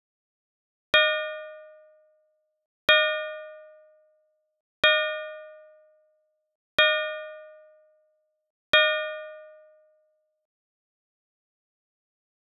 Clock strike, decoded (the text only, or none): 5